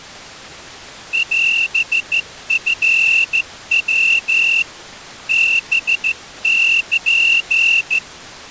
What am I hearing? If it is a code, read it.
Morse code (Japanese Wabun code), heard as a whistle, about 14 wpm. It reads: オチヤ ハル